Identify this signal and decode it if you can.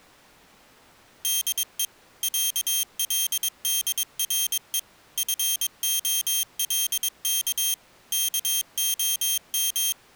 Morse code (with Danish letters), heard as a high beeper, machine-sent, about 22 wpm, 3200 Hz. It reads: DE ÆLDRE FOLK KOM